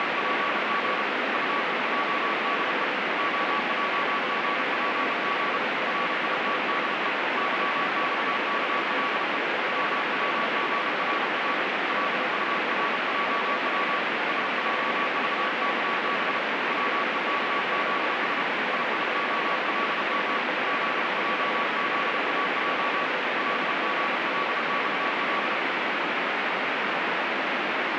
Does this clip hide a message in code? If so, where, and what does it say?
Yes: Morse code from 0.0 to 25.6 s, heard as a keyed tone, hand-sent with a paddle, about 32 wpm, 1140 Hz, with heavy radio static. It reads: … UEJDE OJGPG RITDE YXKLE WWGRA LURJW SJVKB WEKZS IIOLM ZJZAJ LGLXL